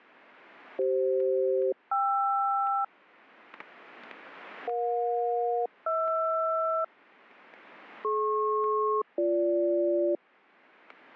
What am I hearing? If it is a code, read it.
Aircraft SELCAL, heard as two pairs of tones, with static crashes. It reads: CF-KR EJ-HR DP-BG